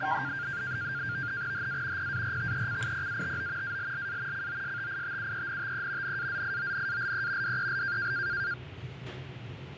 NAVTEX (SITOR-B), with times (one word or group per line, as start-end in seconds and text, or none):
1.5-2.1 HA
2.0-3.8 PARTECIPATO
3.6-4.5 ALLA
4.3-6.2 COSTITUENTE
6.0-7.6 NAZIONALE
7.4-8.1 DEL